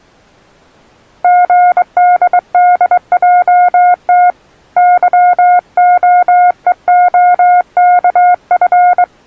Morse code, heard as a keyed tone, hand-sent with a straight key, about 22 wpm, 720 Hz. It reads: GDDJT YOEOKF